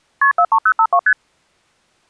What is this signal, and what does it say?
Multi-frequency trunk signalling (R1, as on North American trunks), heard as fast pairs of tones, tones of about 70 ms. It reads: KP 43052 ST